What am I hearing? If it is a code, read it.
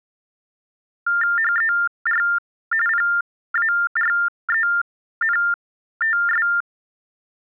TTY/TDD text telephone tones (45.45 baud Baudot), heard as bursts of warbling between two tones, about 400 Hz shift, 1600 Hz centre. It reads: HER PARENTS